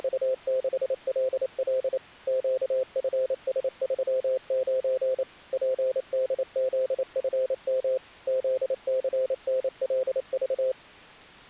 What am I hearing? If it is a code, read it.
Morse code, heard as a keyed tone, machine-sent, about 28 wpm, 520 Hz. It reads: … QFS39 PDZFM ZCNLV